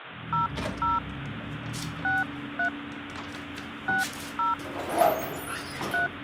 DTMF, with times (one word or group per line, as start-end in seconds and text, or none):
0.3-1.0 00
2.0-2.7 63
3.9-4.5 60
5.9-6.1 3